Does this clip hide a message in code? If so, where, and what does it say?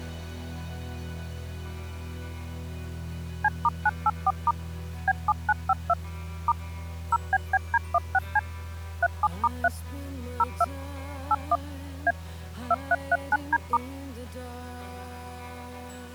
Yes: DTMF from 3.4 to 13.8 s, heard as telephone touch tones, dialled by machine, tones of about 40 ms. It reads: C*984* B7952 * 0BBD16C 37*3 02 81 A 2339D*